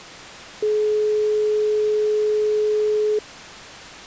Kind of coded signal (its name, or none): telephone call progress tone